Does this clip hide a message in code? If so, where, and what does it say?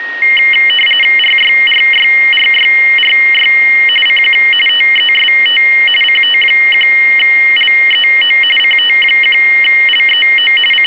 Yes: RTTY (45.45 baud, 850 Hz shift) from 0.2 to 10.9 s, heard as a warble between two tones, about 2550 Hz centre, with a steady whistle near 1870 Hz. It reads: RYRYRYRY CQ TEST CT1LEO CT1LEO …